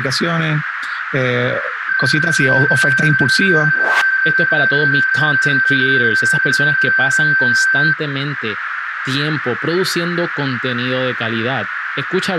PSK31 (31.25 baud), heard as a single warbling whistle, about 1550 Hz, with radio static, a narrow filter and speech in Spanish.